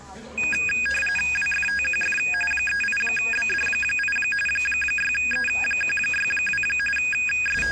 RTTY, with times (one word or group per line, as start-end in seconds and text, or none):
1.4-2.2 WFTQF
2.5-4.2 38BD8
4.5-6.6 6E162
7.0-7.7 …